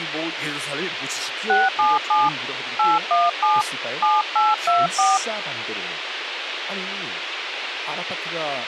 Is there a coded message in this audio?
Yes: DTMF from 1.5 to 5.2 s, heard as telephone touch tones, dialled by hand, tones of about 190 ms, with radio hiss and speech in Korean. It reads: 677 817 7824